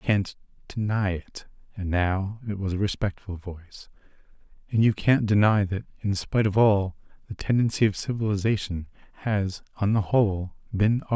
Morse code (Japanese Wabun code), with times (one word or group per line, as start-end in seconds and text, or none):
none